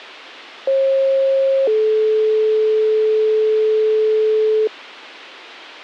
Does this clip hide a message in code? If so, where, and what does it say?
Yes: two-tone page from 0.7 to 4.7 s, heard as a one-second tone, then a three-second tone, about 540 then 430 Hz.